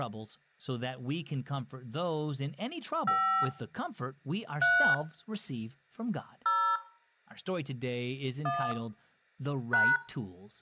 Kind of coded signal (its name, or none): DTMF